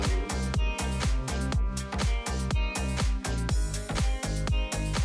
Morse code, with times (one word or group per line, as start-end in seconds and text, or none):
none